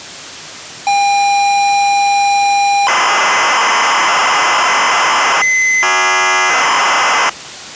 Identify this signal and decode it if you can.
ZX Spectrum tape loading, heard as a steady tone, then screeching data.